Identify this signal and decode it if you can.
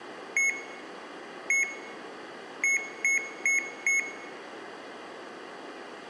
Beep code, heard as beeps from a small speaker, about 2200 Hz, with room echo. 1-1-4. In Phoenix BIOS tables: BIOS ROM checksum failure.